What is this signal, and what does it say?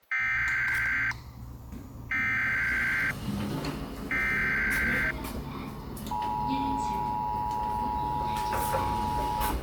Emergency Alert System (SAME) tones (header bursts, then the 853 and 960 Hz attention tone), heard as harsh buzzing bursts, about 520.83 baud, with the noise inside a lift.